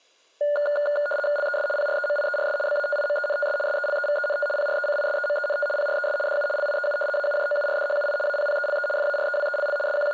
RTTY (75 baud, 850 Hz shift), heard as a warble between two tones, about 1010 Hz centre, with room echo. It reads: LES PREMIERS BATIMENTS SELEVENT PRECISEMENT PRES DU LIEU AUJOURDHUI APPELE FAREWELL …